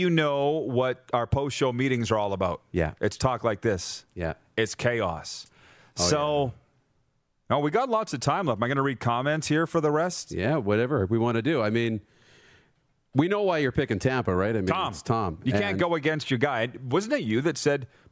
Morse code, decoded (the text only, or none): none